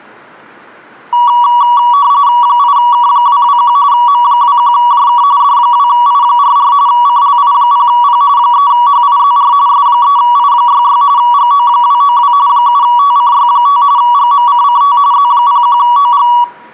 RTTY (45.45 baud, 170 Hz shift), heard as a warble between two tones, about 1050 Hz centre, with room echo. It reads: 8K221 M21JK D2I44 CLI0P 3HIZR S3I66 GO292 7TCY5 GMCCT Z01OG